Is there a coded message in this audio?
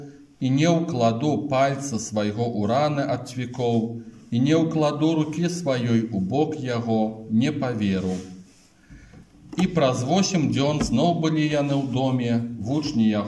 No.